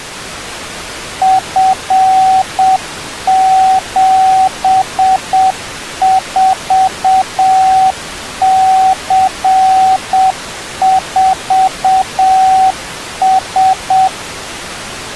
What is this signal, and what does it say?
Morse code, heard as a keyed tone, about 7 wpm, 760 Hz. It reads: F74C4S